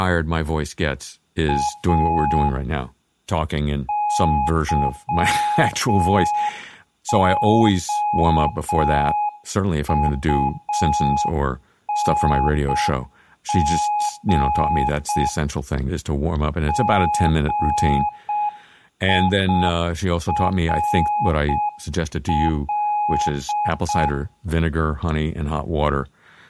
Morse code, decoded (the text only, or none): A YOUNG GIRL